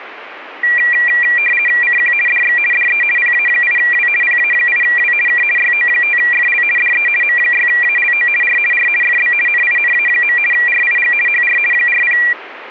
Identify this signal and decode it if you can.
RTTY (50 baud, 450 Hz shift), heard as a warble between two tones, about 2150 Hz centre. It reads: CQ DX DE PA8W PA8W K YO5FL DE M6ALO R R FB NINA. RIG HR 40